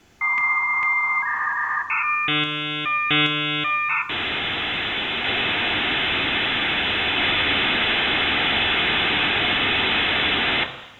Dial-up modem handshake (V.34 or later), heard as a whistle, warbles, then hiss, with room echo.